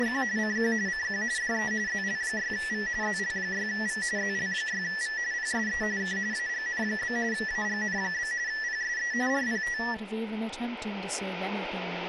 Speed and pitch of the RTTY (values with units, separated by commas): 45.45 baud, 170 Hz shift, 1850 Hz centre